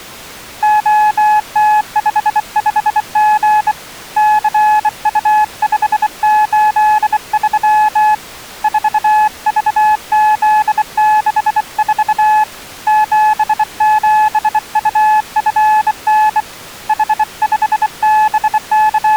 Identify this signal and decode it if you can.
Morse code, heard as a keyed tone, hand-sent with a bug key, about 24 wpm, 850 Hz. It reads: OT55G CU583 4VZ64 77UFN …